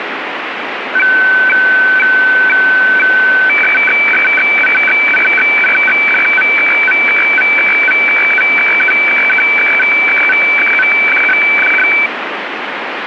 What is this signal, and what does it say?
Weather fax (radiofax), 120 lines a minute, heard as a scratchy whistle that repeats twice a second, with radio static.